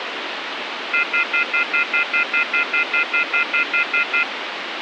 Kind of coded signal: telephone call progress tone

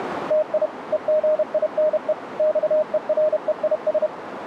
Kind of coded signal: Morse code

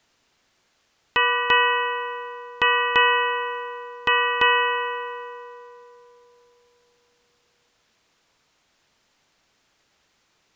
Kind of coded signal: ship's bell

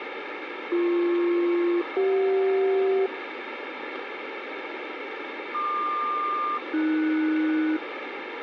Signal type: aircraft SELCAL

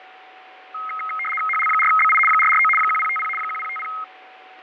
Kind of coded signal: RTTY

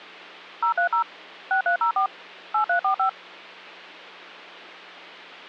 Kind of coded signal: DTMF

